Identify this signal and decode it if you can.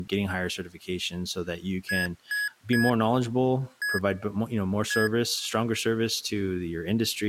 Beep code, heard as beeps from a small speaker, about 1700 Hz, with speech in English. 3-1-1. In Phoenix BIOS tables: DMA register failure.